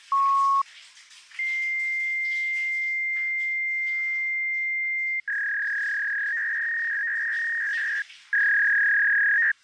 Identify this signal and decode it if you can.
Fax machine handshake, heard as a beep, a long tone and a warble, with the noise of a restroom.